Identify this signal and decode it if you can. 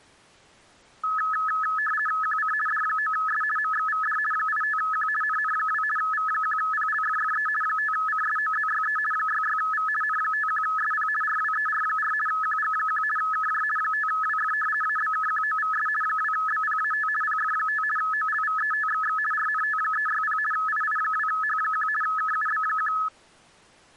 RTTY (50 baud, 450 Hz shift), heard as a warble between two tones, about 1500 Hz centre. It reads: QC D9S MXVD 85Q NN2 V1PLFFE 5CSOZYE 66V N51SP RWER4 QG1 KJ 5WF ABKQOVS 2BPAT PF5 OLVETXX RNT360 II2H1 KUB1